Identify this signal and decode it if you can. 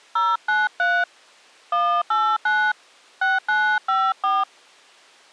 DTMF, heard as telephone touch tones, dialled by hand, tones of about 230 ms. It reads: 093 189 6954